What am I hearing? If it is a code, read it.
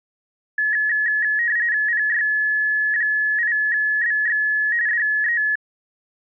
RTTY (45.45 baud, 170 Hz shift), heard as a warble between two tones, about 1800 Hz centre. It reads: PY8BX DE